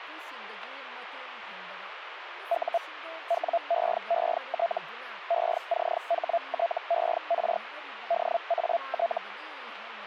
Hellschreiber (Feld-Hell, 122.5 baud), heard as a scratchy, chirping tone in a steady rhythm, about 680 Hz, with radio static and speech in Manipuri. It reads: U WEET ECHTER DAT